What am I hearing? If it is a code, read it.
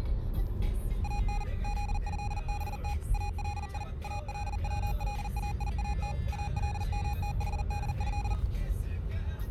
Morse code (Arabic alphabet), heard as electronic beeps, machine-sent, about 40 wpm, 820 Hz, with the noise inside a car. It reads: ان ذهبت الي الولايات المتحده